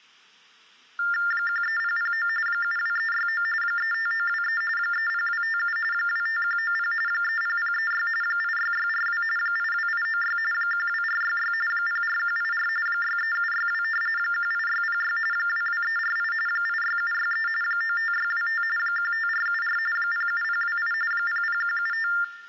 TTY/TDD text telephone tones (45.45 baud Baudot), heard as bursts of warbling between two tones, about 400 Hz shift, 1600 Hz centre. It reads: 13009 72369 35923 30257 25190 30036 86642 82896 12466 04184 63762 18606 22348 86763 95625 15474 07028 00175